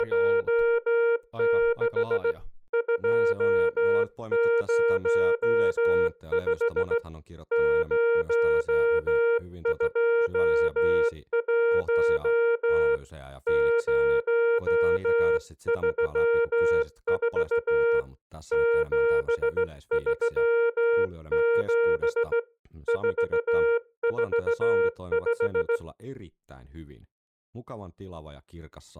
Morse code, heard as a keyed tone, hand-sent with a straight key, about 16 wpm, 470 Hz, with speech in Finnish. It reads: … 205 021 034 737 445